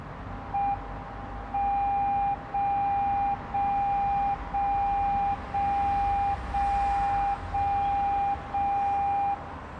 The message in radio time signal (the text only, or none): M 0 0 0 0 0 0 0 0